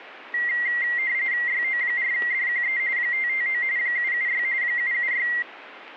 RTTY (45.45 baud, 170 Hz shift), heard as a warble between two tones, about 2000 Hz centre. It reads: YO4DQE 559 776 776